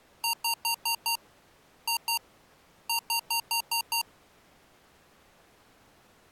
Beep code, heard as beeps from a small speaker, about 920 Hz. 5-2-6.